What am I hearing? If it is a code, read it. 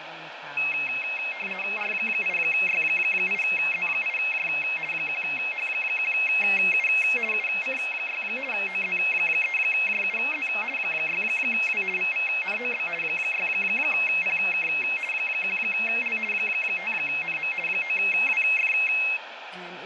RTTY (50 baud, 450 Hz shift), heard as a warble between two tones, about 2350 Hz centre, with radio static, fading and speech in English. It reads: R8Y8Z8J 1H1U UC6 OZ3JUZ 6W VVNOB 6PK 1L 5NM 9WF